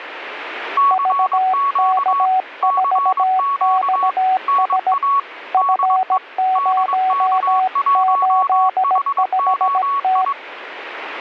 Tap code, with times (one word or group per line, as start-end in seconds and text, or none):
none